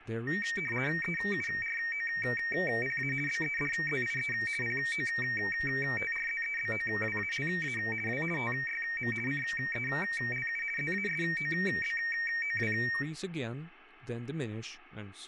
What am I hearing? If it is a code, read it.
RTTY (50 baud, 450 Hz shift), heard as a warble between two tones, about 2050 Hz centre, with speech in English. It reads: EUROPA BEDZIE POTRZEBOWALA W TYM CELU ZASOBOW